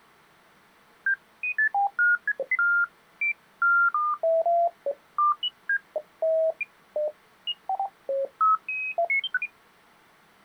Electronic bleeps of random pitch and length. There is no code.